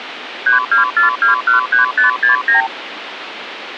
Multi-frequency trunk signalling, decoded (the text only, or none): 324213569